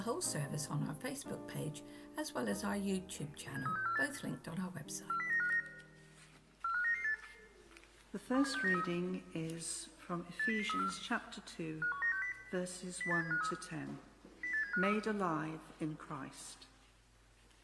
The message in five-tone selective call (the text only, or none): 73648 40959 45998 27693 80034 51960 08753 08753